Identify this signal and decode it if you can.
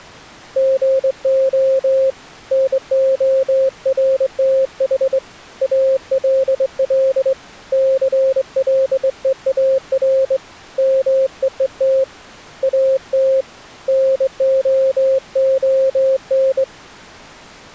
Morse code, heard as a keyed tone, hand-sent with a straight key, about 22 wpm, 530 Hz. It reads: GO NORTH ALL CLEAR MEET AT NOON